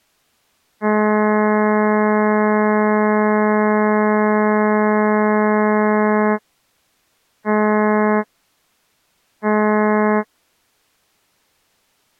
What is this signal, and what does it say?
Ship horn signal, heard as a ship's horn, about 210 Hz. 1 long, 2 short. At sea: a vessel in fog that is sailing, fishing, towing or hampered.